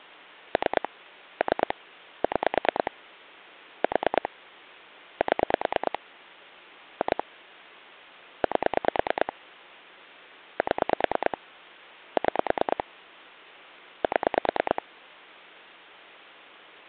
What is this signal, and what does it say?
Pulse dialling, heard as clicks on a phone line, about 9 pulses a second. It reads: 3 3 6 4 7 2 8 7 6 7